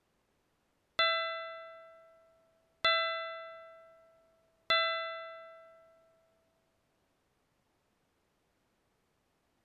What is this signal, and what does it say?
Clock strike, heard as a bell. 3. Three o'clock.